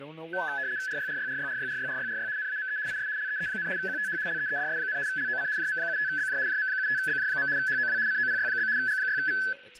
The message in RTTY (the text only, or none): RYRYRYRYRYRYRY NAME IS LEE, QTH LEEDS, LOC JM75BJ JM75BJ. HOW COPY? G6V